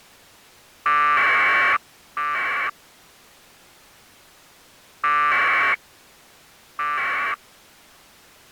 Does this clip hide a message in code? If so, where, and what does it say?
Yes: packet radio (AX.25, as in APRS), 1200 baud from 0.9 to 7.3 s, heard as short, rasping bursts.